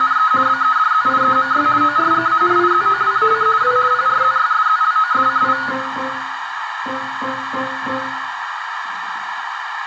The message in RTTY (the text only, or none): … BEDZIEMY ORGANIZOWAC W PRZYSZLOSCI